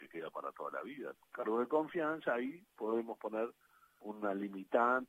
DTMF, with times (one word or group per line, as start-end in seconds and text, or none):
none